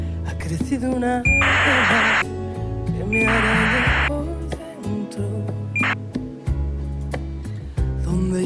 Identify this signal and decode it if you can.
ACARS aircraft data, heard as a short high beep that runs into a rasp, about 2400 baud.